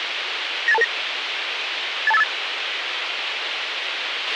Five-tone selective call (EIA), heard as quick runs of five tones, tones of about 30 ms, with radio hiss and a squelch burst at the end. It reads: 98229 82858